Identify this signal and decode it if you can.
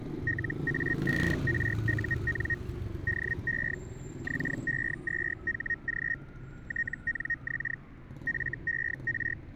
Hellschreiber (Feld-Hell, 122.5 baud), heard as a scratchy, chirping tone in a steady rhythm, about 1850 Hz, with static crashes and street noise. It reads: LA5RUN DE XE2HG TNX FER